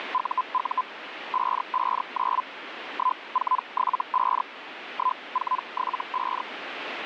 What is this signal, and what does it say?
Hellschreiber (Feld-Hell, 122.5 baud), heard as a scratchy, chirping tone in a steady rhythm, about 1010 Hz, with radio static. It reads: … 559 1475 1475